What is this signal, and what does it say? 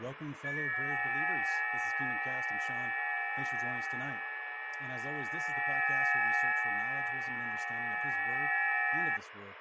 FT8 (several signals at once), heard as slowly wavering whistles, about 6.25 baud, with radio static, fading and speech in English.